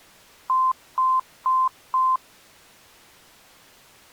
Beep code, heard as beeps, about 1040 Hz. 4 short. In AMI BIOS tables: system timer failure; in Dell tables: memory read or write failure.